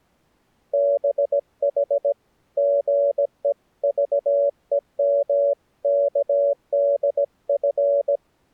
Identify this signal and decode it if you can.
Morse code (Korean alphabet), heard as a keyed tone, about 17 wpm, 570 Hz. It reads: 두 사람은